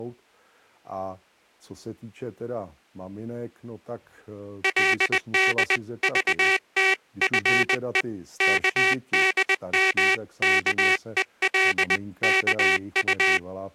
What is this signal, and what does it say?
Morse code (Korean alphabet), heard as a buzzer, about 20 wpm, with speech in Czech. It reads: 그러나 음악이